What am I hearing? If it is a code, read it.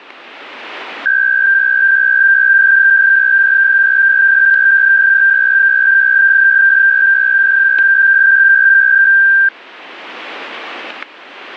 PSK63 (62.5 baud), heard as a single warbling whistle, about 1600 Hz, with static crashes.